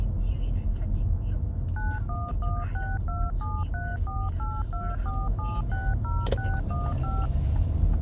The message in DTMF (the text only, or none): 91162734824760615